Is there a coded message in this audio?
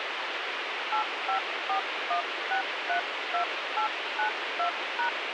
Yes: DTMF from 0.9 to 5.1 s, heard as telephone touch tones, dialled by hand, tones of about 100 ms, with radio hiss. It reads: 8541632892#